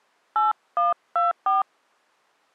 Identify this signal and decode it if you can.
DTMF, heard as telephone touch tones, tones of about 160 ms. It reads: 8124